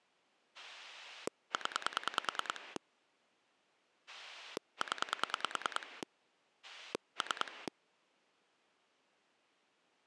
Pulse dialling, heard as a rotary dial, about 10 pulses a second. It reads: 0 0 3